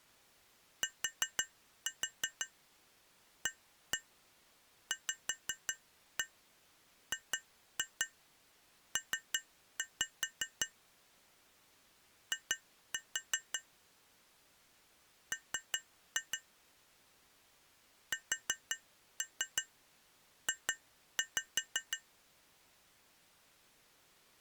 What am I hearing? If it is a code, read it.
Tap code, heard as taps on glass, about 5 knocks a second. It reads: TAVGP I M SJ